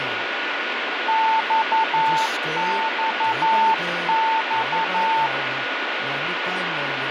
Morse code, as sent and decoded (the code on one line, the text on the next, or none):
-..- -..- -..-
XXX